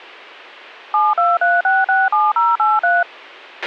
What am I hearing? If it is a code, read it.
DTMF, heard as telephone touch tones, dialled by machine, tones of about 200 ms, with a squelch burst at the end. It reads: 723667083